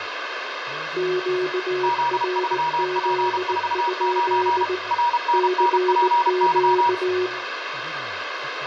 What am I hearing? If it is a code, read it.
Morse code, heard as two keyed tones, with radio static, room echo and speech in Korean. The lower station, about 19 wpm, 370 Hz: QRZ? CQ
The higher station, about 32 wpm, 960 Hz: Z3P49 RNNPY